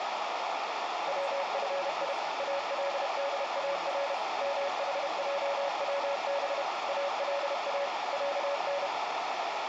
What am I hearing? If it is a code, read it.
Morse code (Arabic alphabet), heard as a keyed tone, machine-sent, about 31 wpm, 560 Hz, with radio static, a narrow filter and speech in English. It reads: وفي الدار محجوب الا عن